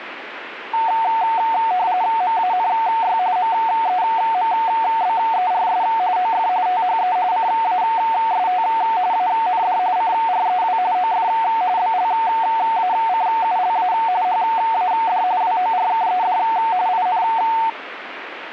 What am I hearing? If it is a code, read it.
RTTY (45.45 baud, 170 Hz shift), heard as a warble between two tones, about 820 Hz centre, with radio static. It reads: MANY MEMBERS OF THE CAST AND CREW OF BLACULA HAD WORKED IN